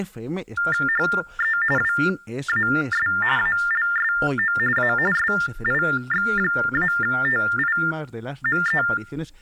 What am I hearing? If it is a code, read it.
TTY/TDD text telephone tones (45.45 baud Baudot), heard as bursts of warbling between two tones, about 400 Hz shift, 1600 Hz centre, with speech in Spanish. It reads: HE WAS ALSO A SIX-TIME